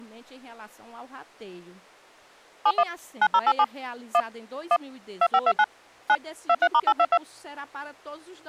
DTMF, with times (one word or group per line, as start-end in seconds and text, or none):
2.7-2.8 71
3.2-3.6 9087
4.1-4.2 1
4.7-4.8 1
5.2-5.6 2529
6.1-6.2 9
6.5-7.2 23*822